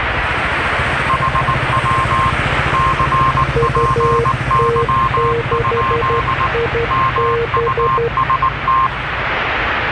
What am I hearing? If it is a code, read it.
Morse code, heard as two keyed tones, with radio static and the noise of a residential street. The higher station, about 19 wpm, 1060 Hz: HW CPY? MUST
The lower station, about 12 wpm, 470 Hz: UT6IB